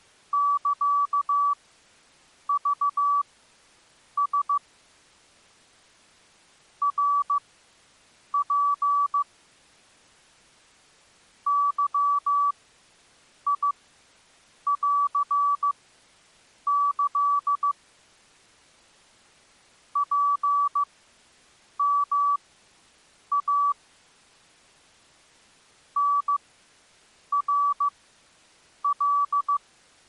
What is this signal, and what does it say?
Morse code (Japanese Wabun code), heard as a keyed tone, machine-sent, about 15 wpm, spaced as for 7 wpm, 1150 Hz. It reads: サクラ ナツ ゲンキ ツヨイ タナカ